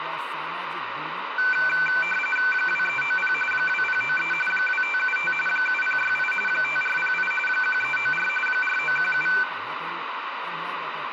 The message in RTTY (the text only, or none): 2390 2093 2575 7068 5408 1394 4917